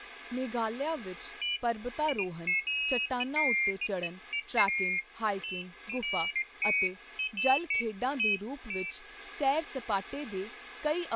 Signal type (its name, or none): none